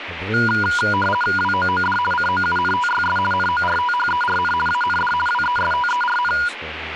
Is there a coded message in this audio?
Yes: RTTY (50 baud, 450 Hz shift) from 0.3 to 6.5 s, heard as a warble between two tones, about 1210 Hz centre, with radio static and speech in English. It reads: WOOD COUNTYS NORTHERN AND WESTERN